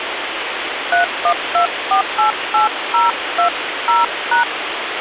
DTMF, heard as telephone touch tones, dialled by hand, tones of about 120 ms, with phone line noise. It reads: 312488020#